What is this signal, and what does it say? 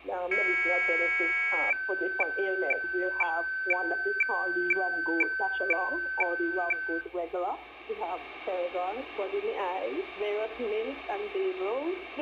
Weather fax (radiofax), 120 lines a minute, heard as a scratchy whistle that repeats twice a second.